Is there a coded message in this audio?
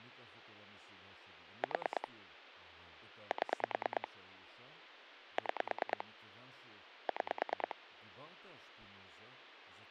Yes: pulse dialling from 1.6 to 7.7 s, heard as clicks on a phone line, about 9 pulses a second, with speech in Hebrew. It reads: 4 7 6 6